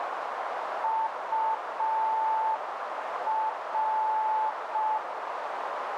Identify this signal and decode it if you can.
Morse code, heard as a keyed tone, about 5 wpm, 880 Hz, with radio static and a narrow filter. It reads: UR